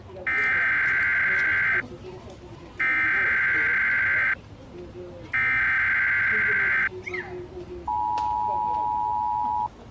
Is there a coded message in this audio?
Yes: Emergency Alert System (SAME) tones (header bursts, then the 853 and 960 Hz attention tone) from 0.3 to 9.7 s, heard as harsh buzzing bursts, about 520.83 baud, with the noise of a park.